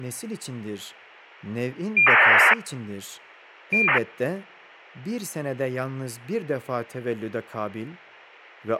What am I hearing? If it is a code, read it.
ACARS aircraft data, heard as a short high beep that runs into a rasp, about 2400 baud, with a squelch burst at the end and speech in Turkish.